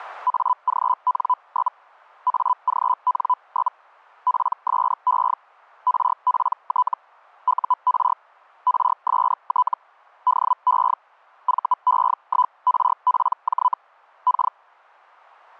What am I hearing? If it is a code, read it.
Hellschreiber (Feld-Hell, 122.5 baud), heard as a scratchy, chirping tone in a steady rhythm, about 1000 Hz. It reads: AGN? AGN? PSE RPT UR RST DE VE1RPJ K